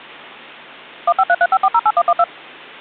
DTMF, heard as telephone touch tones, dialled by machine, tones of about 50 ms. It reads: 15335408112